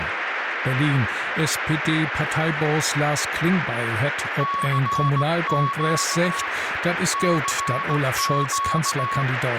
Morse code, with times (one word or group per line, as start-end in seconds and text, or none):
4.4-6.5 CQ
7.1-9.2 CQ